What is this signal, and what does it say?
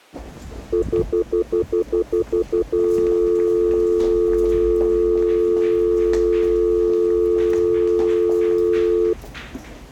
Telephone call progress tone (North American plan), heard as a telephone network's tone, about 350, 440 Hz, 0.1 s on and 0.1 s off, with the noise of a subway station. Stutter dial tone.